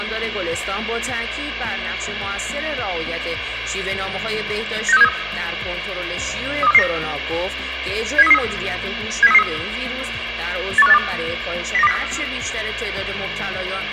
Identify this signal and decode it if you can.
Five-tone selective call (EEA), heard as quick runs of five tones, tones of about 40 ms, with radio hiss and room echo. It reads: 96373 32449 70333 70333 81582 09204